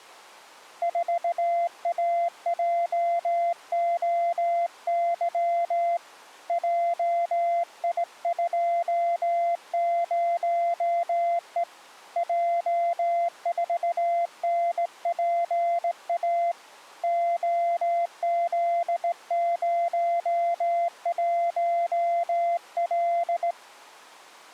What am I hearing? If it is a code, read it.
Morse code, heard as a keyed tone, hand-sent with a straight key, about 18 wpm, 690 Hz. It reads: 4AJOY JI20E J4NPA OZ01L